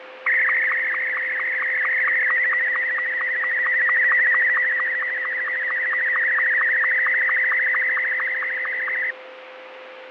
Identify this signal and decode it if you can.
SSTV (slow-scan television), Martin M2, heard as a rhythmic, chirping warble, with radio static and a steady whistle near 520 Hz.